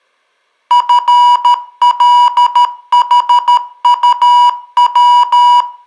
Morse code, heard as electronic beeps, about 13 wpm, 970 Hz, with room echo. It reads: FLHUW